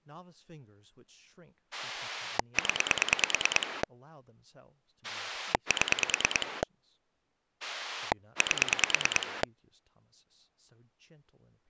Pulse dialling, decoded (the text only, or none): 0 7 8